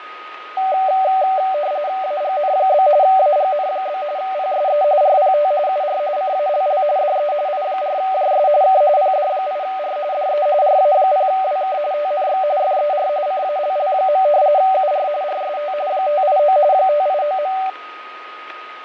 RTTY (45.45 baud, 170 Hz shift), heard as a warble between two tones, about 680 Hz centre, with radio static, fading and a steady whistle near 1250 Hz. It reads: AGN? AGN? PSE RPT UR CALL DE I4JS K PD8R DE RA0WK TNX FER CALL. UR RST 589 589.